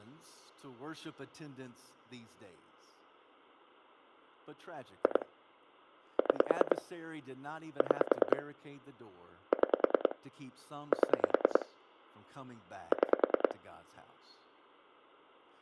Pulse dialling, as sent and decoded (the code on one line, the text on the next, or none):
2 / 6 / 6 / 6 / 7 / 6
2 6 6 6 7 6